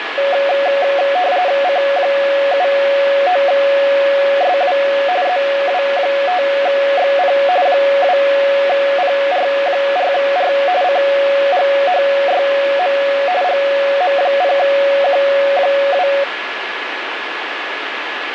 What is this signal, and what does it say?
RTTY (45.45 baud, 170 Hz shift), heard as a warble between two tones, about 640 Hz centre, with radio static and a steady whistle near 1700 Hz. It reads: C79SW ZW5XP 2PR4R CGHYM GM0Q2